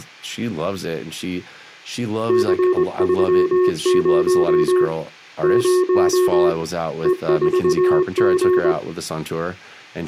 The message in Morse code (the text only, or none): C30 0 E4G